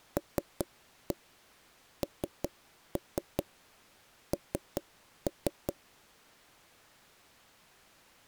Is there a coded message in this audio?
Yes: tap code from 0.2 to 5.8 s, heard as knocks on wood, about 5 knocks a second. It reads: LNN